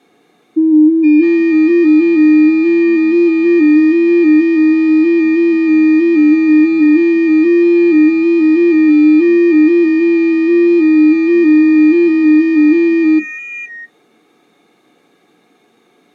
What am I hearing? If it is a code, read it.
FT8 (several signals at once), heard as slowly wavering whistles, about 6.25 baud.